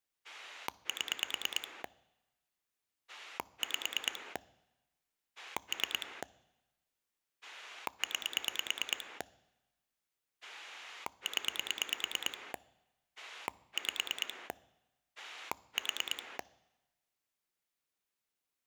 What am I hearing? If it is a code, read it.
Pulse dialling, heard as a rotary dial, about 9 pulses a second. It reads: 7 5 3 9 0 5 4